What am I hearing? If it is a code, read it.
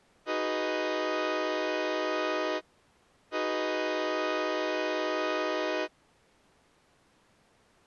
Train horn signal, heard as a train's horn. 2 long. On North American railways: brakes released, proceed.